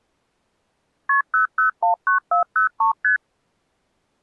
Multi-frequency trunk signalling (R1, as on North American trunks), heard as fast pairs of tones, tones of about 120 ms. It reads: KP 0019403 ST